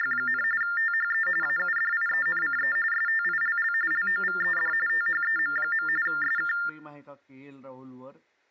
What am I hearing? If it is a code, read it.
TTY/TDD text telephone tones (45.45 baud Baudot), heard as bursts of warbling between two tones, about 400 Hz shift, 1600 Hz centre, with speech in Gujarati. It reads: … THE AUDIENCE STILL LOVED THEM. SK